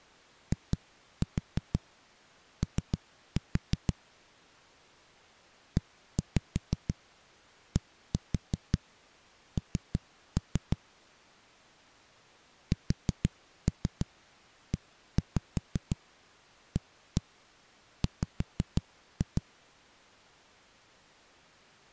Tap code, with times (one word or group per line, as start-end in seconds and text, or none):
0.5-3.9 IO
5.8-10.8 EDN
12.7-19.4 SEAW